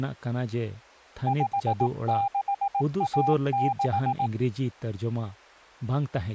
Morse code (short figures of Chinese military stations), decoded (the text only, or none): 5616